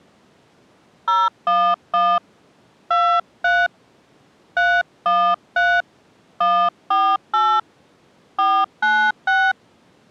DTMF, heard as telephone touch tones, dialled by hand, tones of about 270 ms. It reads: 011 23 313 148 496